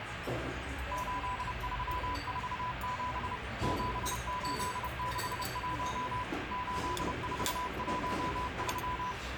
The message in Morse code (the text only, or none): 8347 7861 8413